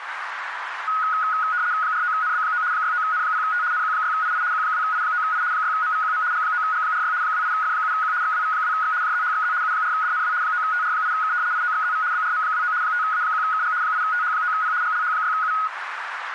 RTTY (75 baud, 170 Hz shift), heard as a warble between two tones, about 1360 Hz centre, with radio static and a narrow filter. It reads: 49NB9 69N0T NQ6II Q2I9I 6MVQM G9G46 28F7Q XWV2X JZHXZ U4DNW 9TR8K IOXZV BRM29 5A1KG 8TH9P GLH6U